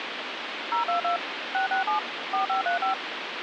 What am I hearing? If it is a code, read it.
DTMF, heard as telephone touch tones, dialled by machine, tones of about 120 ms, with phone line noise. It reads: 022 667 4535